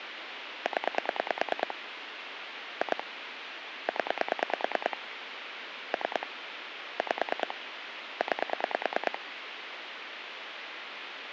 Pulse dialling, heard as clicks on a phone line, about 9 pulses a second, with phone line noise. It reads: 0 2 0 3 5 9